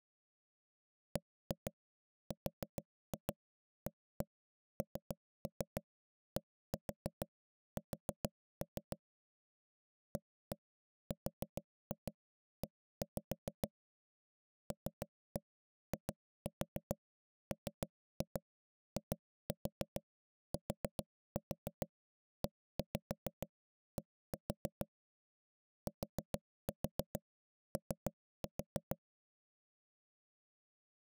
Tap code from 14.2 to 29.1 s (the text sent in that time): LIMITED TO